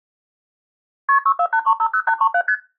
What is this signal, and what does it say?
Multi-frequency trunk signalling (R1, as on North American trunks), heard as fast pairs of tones, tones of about 70 ms. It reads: KP 648350837 ST